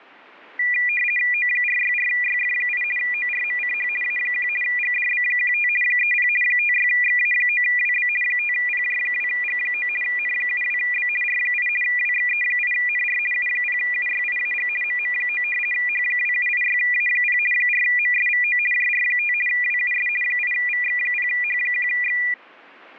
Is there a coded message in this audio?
Yes: RTTY (50 baud, 450 Hz shift) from 0.6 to 22.3 s, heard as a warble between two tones, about 2200 Hz centre. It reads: O464YF8 ORMCH A1 GDB15 30 56XA9WB 5PJ2G9 N72B R8 WXE8NR U0UYIAG MM9 H2786A0 4MSVO JR5 WUS 8VX0H1X